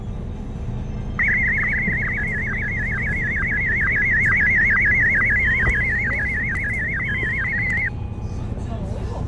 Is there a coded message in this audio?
Yes: SSTV (slow-scan television), Martin M1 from 1.2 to 7.9 s, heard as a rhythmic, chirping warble, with fading, a steady whistle near 490 Hz and the noise inside a bus.